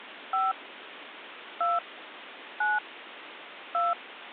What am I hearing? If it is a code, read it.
DTMF, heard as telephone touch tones, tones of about 190 ms, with phone line noise. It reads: 5 2 9 2